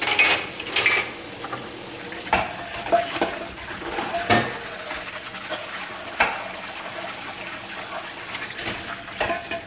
Kitchen noise. There is no code.